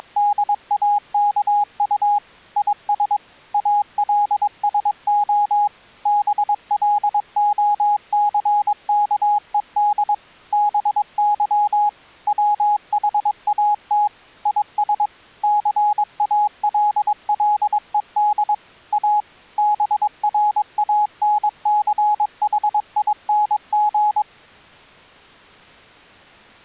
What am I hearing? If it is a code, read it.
Morse code, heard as a keyed tone, machine-sent, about 22 wpm, 830 Hz. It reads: … IS ALSO BLOCKED BY WHAT IS CALLED A BRANCHING